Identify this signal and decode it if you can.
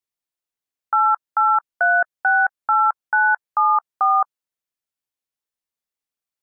DTMF, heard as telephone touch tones, dialled by machine, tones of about 220 ms. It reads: 88368974